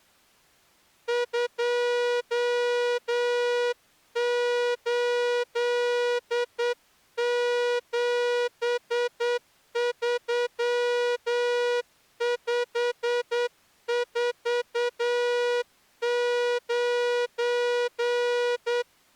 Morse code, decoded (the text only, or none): 2873549